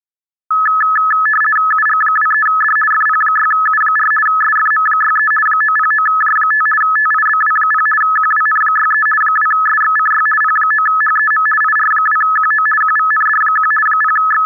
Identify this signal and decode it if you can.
RTTY (50 baud, 450 Hz shift), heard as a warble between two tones, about 1500 Hz centre. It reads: UG23D FP6U4 SFM63 909J5 TIBW0 QWN63 2SXCY P9HEM IR2QO QVND1 …